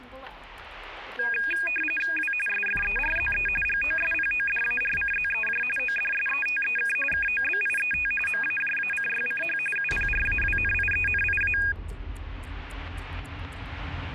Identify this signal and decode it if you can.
RTTY (45.45 baud, 850 Hz shift), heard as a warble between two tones, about 2050 Hz centre, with static crashes. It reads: W SFERZE GOSPODARCZEJ ODSETEK KOBIET MAJACYCH UPRAWNIENIA